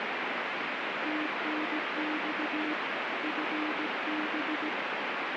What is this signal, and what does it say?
Morse code, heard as a keyed tone, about 17 wpm, 310 Hz, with heavy radio static. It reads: TNX FB